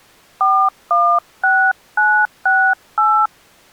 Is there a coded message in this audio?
Yes: DTMF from 0.4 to 3.3 s, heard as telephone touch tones, dialled by hand, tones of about 280 ms. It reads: 416968